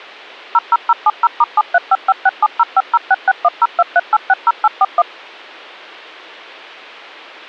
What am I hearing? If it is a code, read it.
DTMF, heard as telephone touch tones, dialled by machine, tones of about 40 ms. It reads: 00070*735567050661023860841